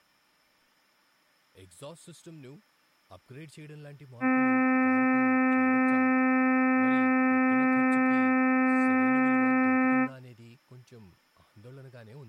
Ship horn signal, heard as a ship's horn, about 260 Hz, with speech in Telugu. 1 long. At sea: a vessel nearing a blind bend, or under power and making way in fog.